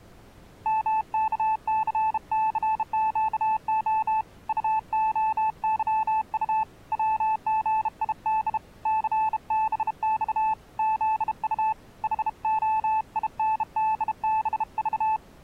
Morse code, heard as a keyed tone, hand-sent with a bug key, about 32 wpm, 870 Hz. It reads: MKCCQO UOYU WGID CBX ZU HOINDBV